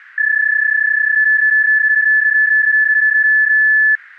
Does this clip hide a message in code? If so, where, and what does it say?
Yes: PSK31 (31.25 baud) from 0.2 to 4.0 s, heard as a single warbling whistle, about 1750 Hz.